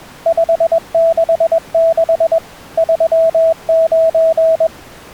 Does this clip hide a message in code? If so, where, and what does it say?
Yes: Morse code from 0.2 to 4.7 s, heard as a keyed tone, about 21 wpm, 660 Hz. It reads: 566 39